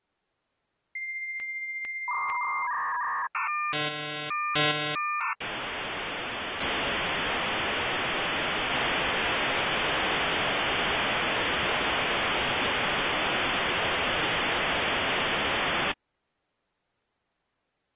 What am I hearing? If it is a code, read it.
Dial-up modem handshake (V.34 or later), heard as a whistle, warbles, then hiss.